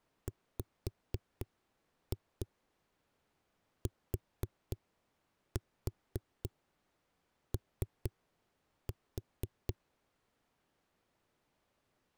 Tap code, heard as knocks on a wall, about 4 knocks a second. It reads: WTO